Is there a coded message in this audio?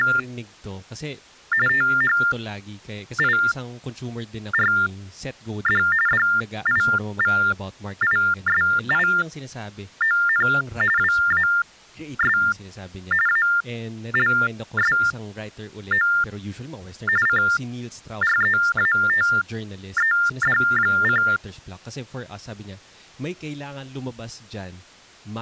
Yes: TTY/TDD text telephone tones (45.45 baud Baudot) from 0.0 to 21.4 s, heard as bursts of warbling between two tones, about 400 Hz shift, 1600 Hz centre, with speech in Filipino. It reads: … THIRD DIVISION WAS ALSO CREATED: